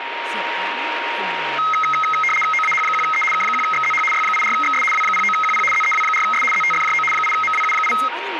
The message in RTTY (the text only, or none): OAH1E K1XZH Y84XS W09QP ZEW4S ZTFJO 8MWU8